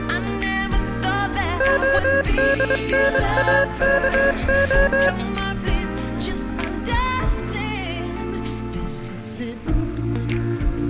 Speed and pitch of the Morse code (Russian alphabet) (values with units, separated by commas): 23 wpm, 550 Hz